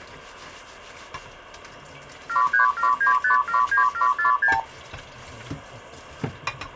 Multi-frequency trunk signalling (R2, with the far end's replies), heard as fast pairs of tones, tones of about 120 ms, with kitchen noise. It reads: 7379579746